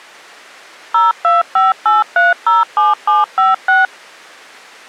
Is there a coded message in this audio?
Yes: DTMF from 0.9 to 3.9 s, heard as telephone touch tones, dialled by machine, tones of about 170 ms. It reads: 0258307756